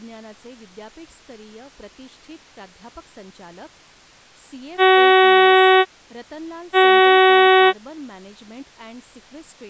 Ship horn signal, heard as a ship's horn, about 380 Hz, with speech in Marathi. 2 short. At sea: I am altering course to port.